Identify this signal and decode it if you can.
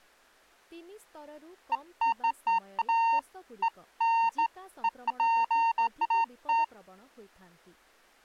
Beeps of irregular length, with speech in Odia. There is no code.